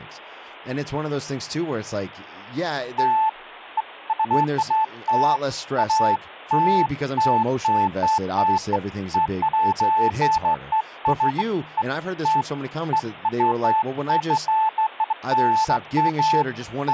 Beeps of irregular length, with speech in English. There is no code.